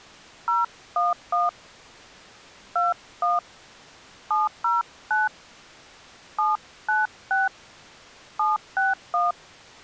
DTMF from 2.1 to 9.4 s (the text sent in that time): 21 709 796 761